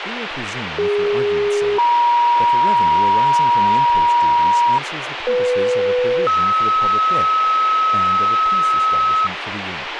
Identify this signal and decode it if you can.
Two-tone page, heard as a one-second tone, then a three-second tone, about 410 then 950 Hz, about 500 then 1290 Hz, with radio hiss and speech in English.